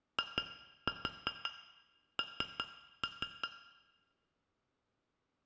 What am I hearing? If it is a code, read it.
Tap code, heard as taps on glass, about 5 knocks a second, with room echo. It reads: IN